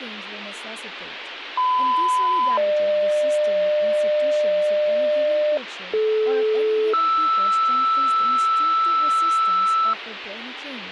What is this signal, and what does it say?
Two-tone page, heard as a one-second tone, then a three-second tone, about 1010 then 600 Hz, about 430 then 1320 Hz, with radio hiss and speech in English.